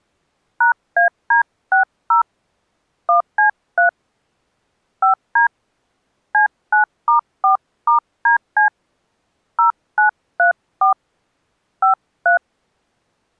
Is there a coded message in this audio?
Yes: DTMF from 0.6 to 12.4 s, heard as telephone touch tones, dialled by hand, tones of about 120 ms. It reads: #AD60 1C3 5D C9*4*DC 0934 53